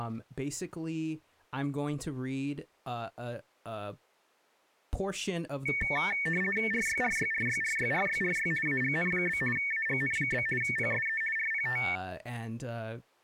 RTTY (50 baud, 450 Hz shift), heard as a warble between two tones, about 2000 Hz centre, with speech in English. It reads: RYRYRYRYRYRY AGN? AGN? PSE RPT